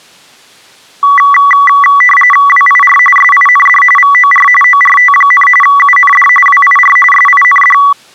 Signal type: RTTY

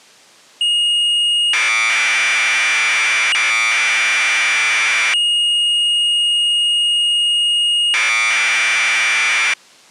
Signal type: Commodore tape loading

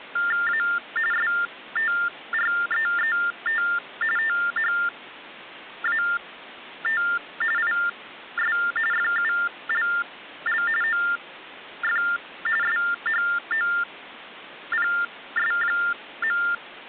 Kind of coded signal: TTY/TDD text telephone tones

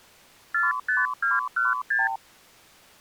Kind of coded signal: multi-frequency trunk signalling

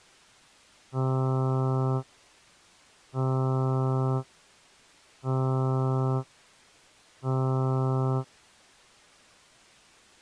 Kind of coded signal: ship horn signal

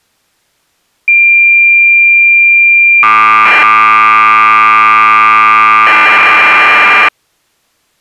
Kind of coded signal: cassette data (Kansas City type)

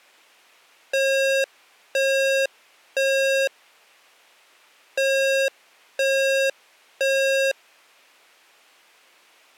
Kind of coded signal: alarm pattern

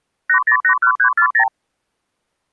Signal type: multi-frequency trunk signalling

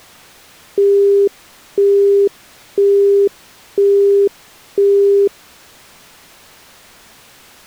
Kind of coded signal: telephone call progress tone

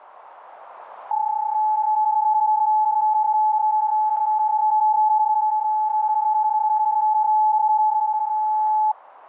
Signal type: PSK31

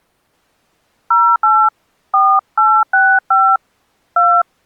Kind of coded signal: DTMF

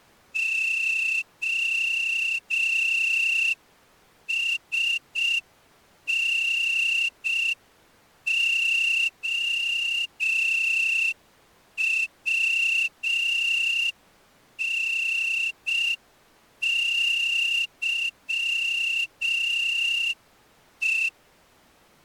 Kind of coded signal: Morse code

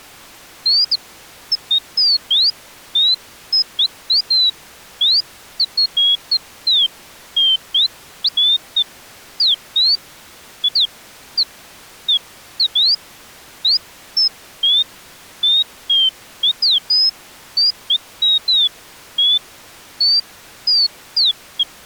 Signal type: none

